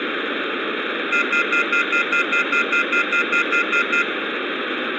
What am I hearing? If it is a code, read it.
Telephone call progress tone (North American plan), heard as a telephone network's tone, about 1400, 2050, 2450, 2600 Hz, 0.1 s on and 0.1 s off, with phone line noise. Off-hook warning tone.